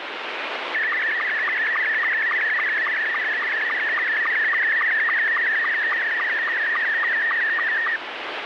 SSTV (slow-scan television), Scottie S2, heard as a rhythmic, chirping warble, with radio static.